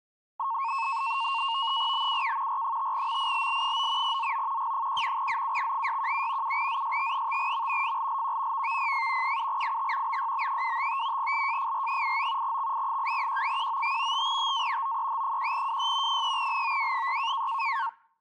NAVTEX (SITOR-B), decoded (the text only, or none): BUK R5MILL9 ZO G1 ZUX617 7ZST5M FLLQ VVPF 7IT BYB255 LJFR89 XI8Q195 5TA OEH1WY 3LOW6